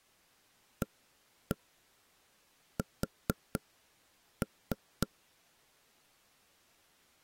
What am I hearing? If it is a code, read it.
Tap code, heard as knocks on wood, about 4 knocks a second. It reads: AS